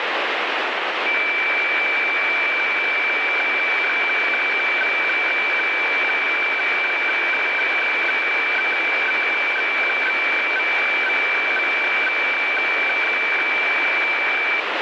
Weather fax (radiofax), 120 lines a minute, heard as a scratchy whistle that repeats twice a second, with heavy radio static.